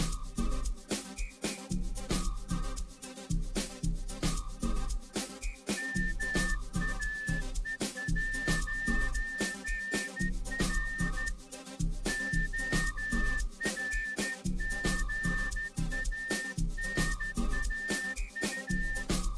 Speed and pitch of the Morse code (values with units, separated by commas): 13 wpm